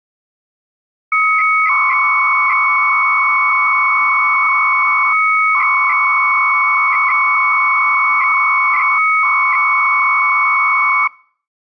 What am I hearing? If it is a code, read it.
300-baud modem data (Bell 103 tones), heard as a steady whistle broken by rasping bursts, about 300 baud, 200 Hz shift.